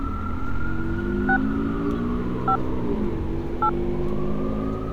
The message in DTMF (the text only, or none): 6 5 8